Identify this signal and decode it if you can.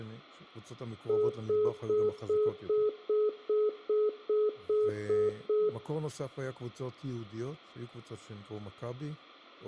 Telephone call progress tone (single-tone plan, as in most of Europe), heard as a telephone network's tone, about 420 Hz, 0.2 s on and 0.2 s off, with room echo and speech in Hebrew. Congestion tone.